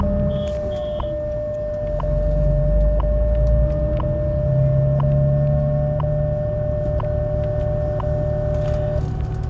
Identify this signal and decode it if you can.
Radio time signal (WWV, Colorado), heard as ticks, one a second, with static crashes and the noise inside a bus.